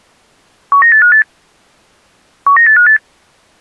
Five-tone selective call (CCIR), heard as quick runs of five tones, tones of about 100 ms. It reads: 19858 19858